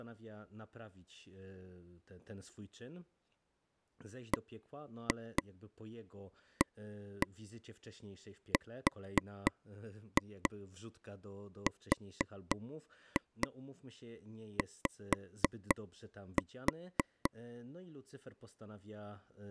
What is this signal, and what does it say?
Tap code, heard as taps on a table, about 3 knocks a second, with speech in Polish. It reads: BARRY